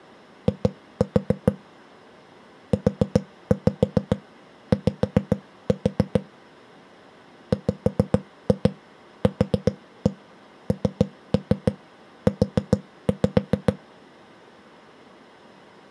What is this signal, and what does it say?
Tap code, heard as knocks on a wall, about 7 knocks a second. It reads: I UY WQNU